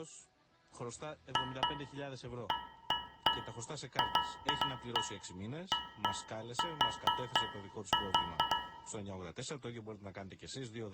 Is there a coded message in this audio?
No, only irregular taps on a metal pipe, with room echo.